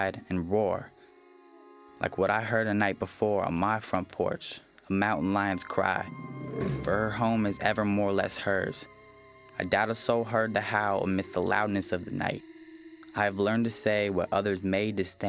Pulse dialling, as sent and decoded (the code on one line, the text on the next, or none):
none